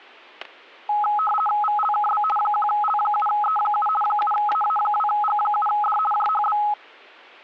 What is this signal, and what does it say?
RTTY (50 baud, 450 Hz shift), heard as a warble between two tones, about 1060 Hz centre, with static crashes. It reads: VLKB 1L7E7 7AA2G7D JHB